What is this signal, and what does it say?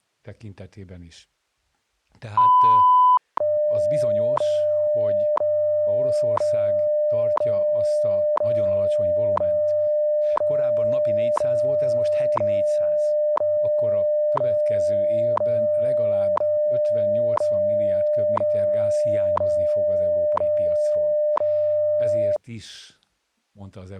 Radio time signal (WWV, Colorado), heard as ticks, one a second, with speech in Hungarian.